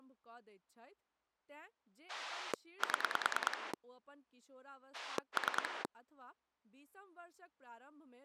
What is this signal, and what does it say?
Pulse dialling, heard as a rotary dial, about 9 pulses a second, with speech in Maithili. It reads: 7 3